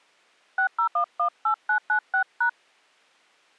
DTMF, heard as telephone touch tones, dialled by hand, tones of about 90 ms. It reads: 60118996#